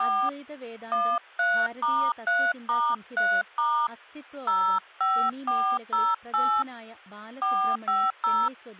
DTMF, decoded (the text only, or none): 4 13*3*3* 05408 450